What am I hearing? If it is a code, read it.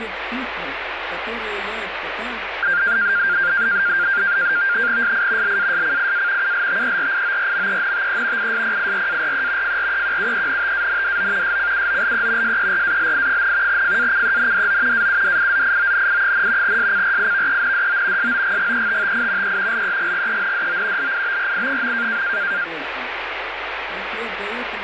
NAVTEX (SITOR-B), 100 baud, 170 Hz shift, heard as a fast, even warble, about 1500 Hz centre, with radio static. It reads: SI LASCIA ULTERIORMENTE ISPIRARE FREQUENTANDO SCUOLE SERALI, FACENDO AUDIZIONI, SCRIVENDO SOGGETTI E LEGGENDO LIBRI.